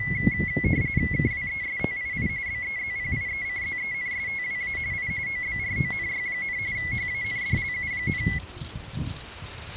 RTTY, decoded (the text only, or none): KWESTII BEZPIECZENSTWA I OBRONY, HANDLU,